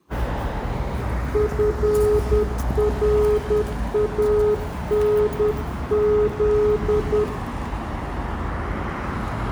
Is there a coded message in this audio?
Yes: Morse code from 1.3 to 7.3 s, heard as a keyed tone, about 10 wpm, 420 Hz, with room echo and street noise. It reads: FRANZ